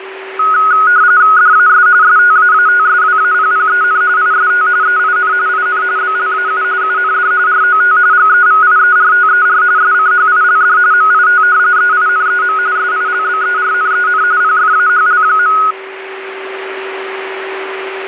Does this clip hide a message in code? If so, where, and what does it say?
Yes: RTTY (45.45 baud, 170 Hz shift) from 0.4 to 15.7 s, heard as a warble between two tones, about 1360 Hz centre, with radio static and a steady whistle near 380 Hz. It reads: DAS STAATSWAPPEN IST EIN IN BLAU UND ROT GEVIERTER SCHILD MIT EINEM SILBERNEN PFAHL.